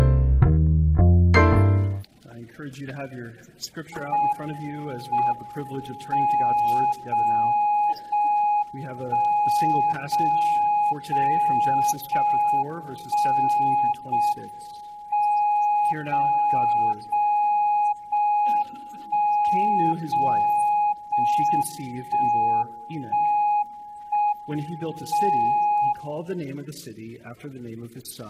Radio time signal (JJY), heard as a tone whose level steps once a second, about 830 Hz. The time is 17:12 Japan time. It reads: M M 0 0 1 0 0 0 1 0 M 0 0 0 1 0 0 1 1 1 M 0